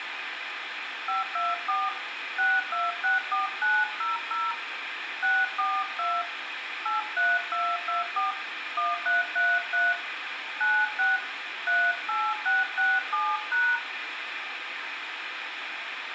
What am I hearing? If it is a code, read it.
DTMF, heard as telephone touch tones, dialled by hand, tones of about 200 ms, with phone line noise and room echo. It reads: 524 6264900 642 83224 1333 96 38667#